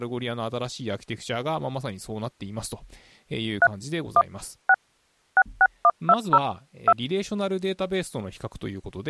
DTMF, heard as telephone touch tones, dialled by machine, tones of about 50 ms, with speech in Japanese. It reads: 3 1 6 66120 2